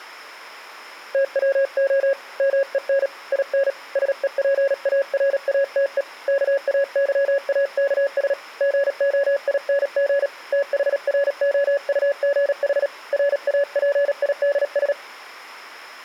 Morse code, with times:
1.1-2.1 TWO
2.4-3.1 MEN
3.3-3.7 IN
4.0-6.0 SEPARATE
6.3-8.3 KAYAKS
8.6-10.3 GOING
10.5-12.9 THROUGH
13.1-14.9 RAPIDS

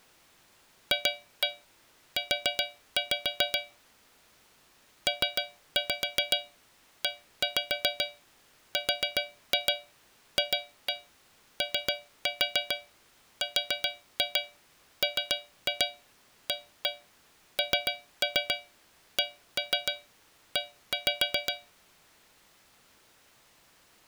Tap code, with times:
0.9-3.6 FU
5.1-21.5 PERFORMANCE

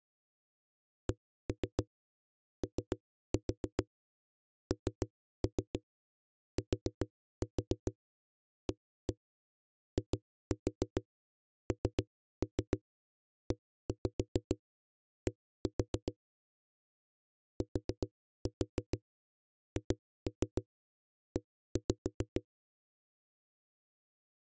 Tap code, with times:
1.1-16.1 CONTAINED
17.6-22.4 THE

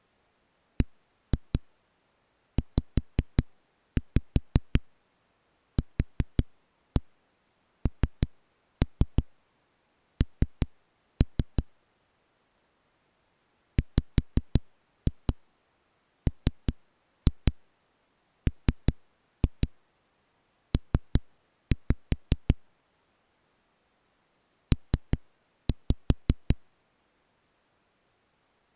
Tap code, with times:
0.8-11.6 BZQNN
13.8-22.5 WMMP
24.7-26.6 P

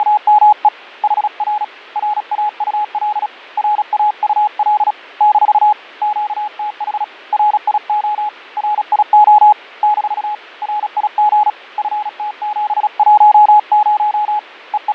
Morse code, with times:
0.0-0.7 …
1.0-1.6 HR
2.0-3.3 RAUL
3.6-4.9 RAUL
5.2-5.7 -
6.0-7.0 QTH
7.3-8.3 RIO
8.6-9.5 RIO
9.8-10.3 -
10.6-11.5 RIG
11.8-14.4 FT710
14.7-14.9 …

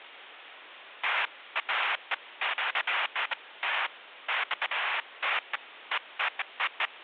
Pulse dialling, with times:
none

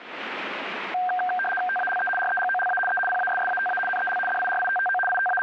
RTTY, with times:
1.7-2.1 TALE
2.2-2.8 REGOLA
2.9-3.0 E
3.1-3.8 PASSATA
3.9-4.2 NEL
4.3-5.0 DIRITTO
5.1-5.4 …

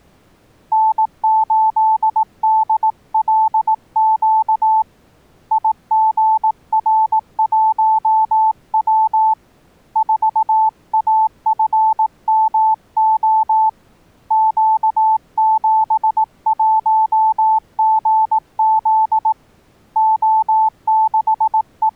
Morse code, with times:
0.7-4.8 N8DLQ
5.5-9.3 IGR1W
10.0-13.7 4AFMO
14.3-19.3 Q71GZ
20.0-22.0 …

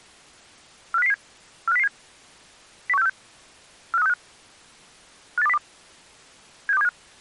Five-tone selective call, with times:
0.9-1.1 45007
1.7-1.9 45007
2.9-3.1 01646
3.9-4.1 45365
5.4-5.6 58202
6.7-6.9 76275

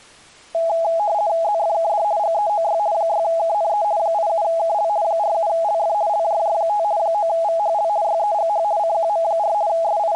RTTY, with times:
1.4-2.0 ZFKD
2.2-2.8 GEOY
2.9-3.8 6KNE
4.0-4.9 87KL
5.0-5.9 47LF
6.1-6.8 LJJ5
7.0-7.9 9VHL
8.0-8.6 YEGH
8.8-9.5 CQM4
9.7-10.2 …

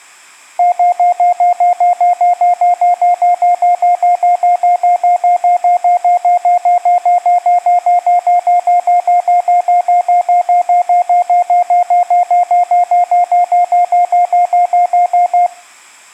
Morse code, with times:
none

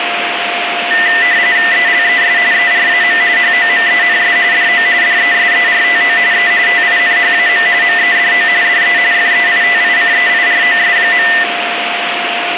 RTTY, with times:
1.7-2.4 ELES
2.5-3.2 ERAM
3.4-4.4 HOMENS
4.5-4.9 DO
5.0-6.2 DESERTO
6.3-6.5 E
6.7-7.7 TINHAM
7.8-8.5 MEDO
8.6-9.0 DE
9.1-11.3 FEITICEIROS.

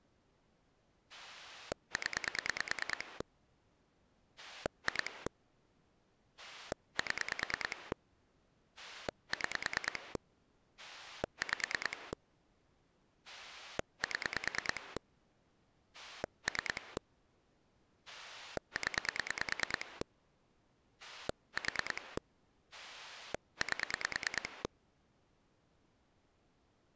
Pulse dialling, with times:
1.1-3.2 0
4.4-5.3 2
6.4-7.9 7
8.8-10.2 6
10.8-12.1 5
13.3-15.0 7
15.9-17.0 3
18.1-20.0 0
21.0-22.2 4
22.7-24.6 8

